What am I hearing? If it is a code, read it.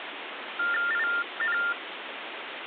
TTY/TDD text telephone tones (45.45 baud Baudot), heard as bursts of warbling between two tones, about 400 Hz shift, 1600 Hz centre, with phone line noise. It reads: IN